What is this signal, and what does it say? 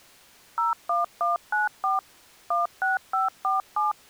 DTMF, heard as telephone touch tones, dialled by machine, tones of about 150 ms. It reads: 01194 16547